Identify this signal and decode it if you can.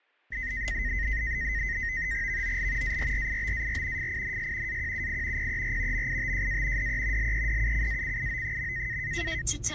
NAVTEX (SITOR-B), 100 baud, 170 Hz shift, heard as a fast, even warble, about 1950 Hz centre, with the noise inside a car. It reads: VOL ARRIBAR FINS AQUI PER MITJA DE LEDUCACIO.